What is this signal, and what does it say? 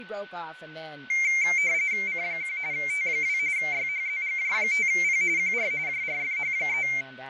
RTTY (45.45 baud, 170 Hz shift), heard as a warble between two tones, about 2200 Hz centre, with fading, a steady whistle near 1500 Hz and speech in English. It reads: C1 T2 YHZGJ5P QR JRFH3